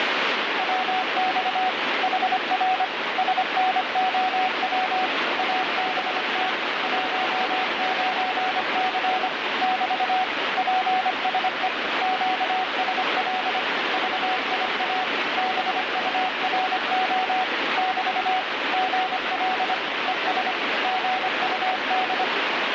Morse code, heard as a keyed tone, machine-sent, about 25 wpm, 750 Hz, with heavy radio static. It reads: WX HR SNOW ABT 19C <BT> PSE QSL VIA BURO <BT> GL ES GUD